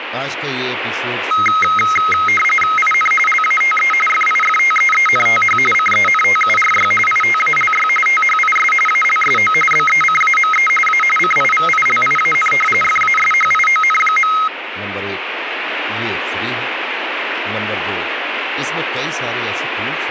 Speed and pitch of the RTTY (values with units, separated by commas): 45.45 baud, 850 Hz shift, 1700 Hz centre